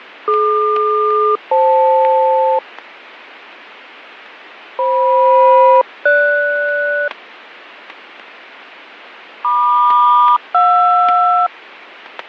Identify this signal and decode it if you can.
Aircraft SELCAL, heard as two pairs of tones, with fading and static crashes. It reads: DQ-FL FM-GS MQ-JR